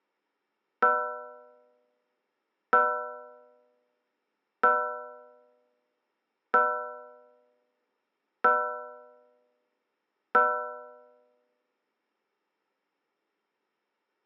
Clock strike, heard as a bell. 6. Six o'clock.